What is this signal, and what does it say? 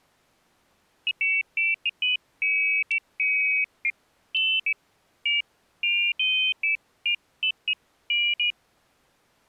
Pairs of high tones at irregular times. There is no code.